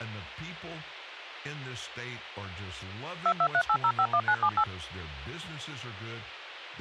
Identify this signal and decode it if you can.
DTMF, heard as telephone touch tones, dialled by machine, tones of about 70 ms, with speech in English. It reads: 2238051978